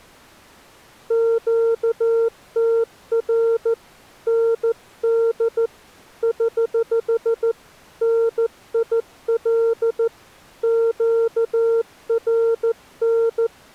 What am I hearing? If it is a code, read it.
Morse code, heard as a keyed tone, hand-sent with a paddle, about 14 wpm, 460 Hz. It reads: QTR ND <HH> NIL QRN